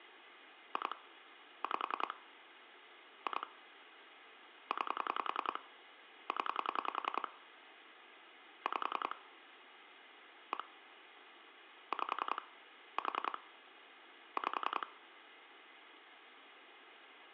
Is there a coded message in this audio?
Yes: pulse dialling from 0.8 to 14.8 s, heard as clicks on a phone line, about 10 pulses a second, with phone line noise. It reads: 2 5 2 9 0 5 1 5 4 5